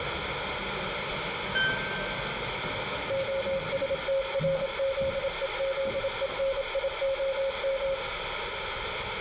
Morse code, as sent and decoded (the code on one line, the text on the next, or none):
--- ... - .-. --.. . --.. . -. .. --- --
OSTRZEZENIOM